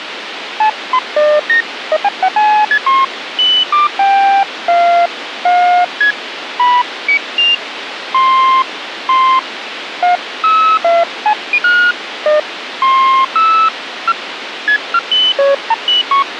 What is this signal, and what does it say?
Electronic bleeps of random pitch and length, with radio hiss. There is no code.